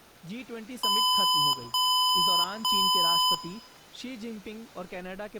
Beep code, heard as beeps from a small speaker, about 1010 Hz, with room echo and speech in Hindi. 3 long. In IBM BIOS tables: keyboard card error.